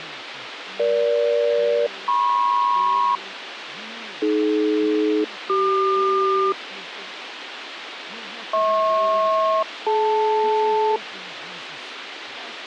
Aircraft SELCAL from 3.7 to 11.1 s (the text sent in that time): AD-CQ HP-DL